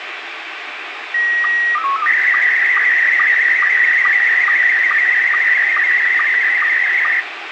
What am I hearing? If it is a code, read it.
SSTV (slow-scan television), Scottie S1, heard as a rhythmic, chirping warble, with heavy radio static.